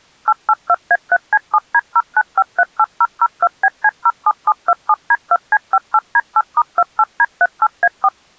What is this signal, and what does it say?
DTMF, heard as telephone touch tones, dialled by machine, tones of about 50 ms. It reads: 882A3C7D09538002BC07727D2C58D8*28D38A4